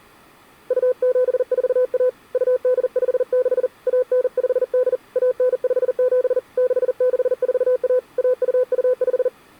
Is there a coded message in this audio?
Yes: Morse code (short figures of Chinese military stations) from 0.6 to 9.3 s, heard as a keyed tone, hand-sent with a paddle, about 40 wpm, 500 Hz. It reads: 2741 2856 1958 1957 6641 1225